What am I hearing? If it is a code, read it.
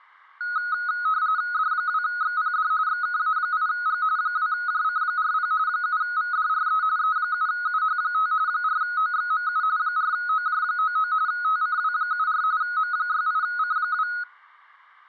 RTTY (45.45 baud, 170 Hz shift), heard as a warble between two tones, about 1360 Hz centre. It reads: D2XPD XKA8G 2JC40 7VDRE E7UH5 4OXMU 4OJ99 TCW74 M68C2